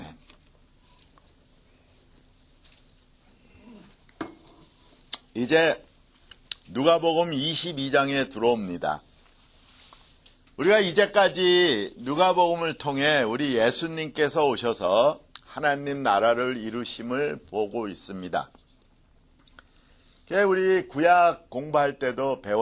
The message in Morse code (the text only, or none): none